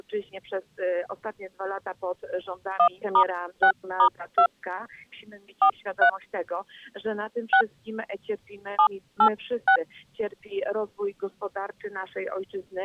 DTMF, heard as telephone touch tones, dialled by hand, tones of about 80 ms. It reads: 1*6*2 43 6 786